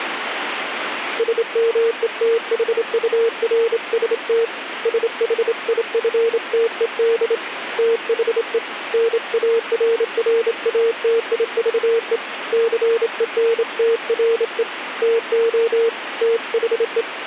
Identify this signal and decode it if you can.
Morse code, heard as a keyed tone, hand-sent with a straight key, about 27 wpm, 460 Hz, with radio static. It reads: SMETHURST SHIFTED THE NARRATIVE CENTRE TO THE